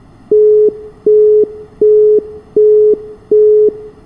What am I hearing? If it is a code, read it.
Telephone call progress tone (as in the UK, Australia and similar networks), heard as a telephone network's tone, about 420 Hz, 0.375 s on and 0.375 s off, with room echo. Busy tone.